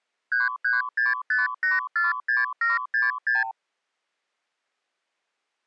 Multi-frequency trunk signalling (R2, with the far end's replies), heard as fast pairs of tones, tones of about 160 ms. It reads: 3365846766